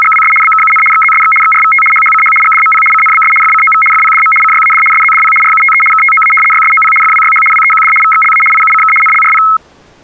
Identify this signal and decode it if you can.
RTTY (75 baud, 850 Hz shift), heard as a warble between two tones, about 1700 Hz centre. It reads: … BKUN XZSX XRVT HHCH GDMP CNBS FCOV FPDM CYAD SZDP RUTE KTOA YSOP FWYH WEQD VXLA IUCK NLRP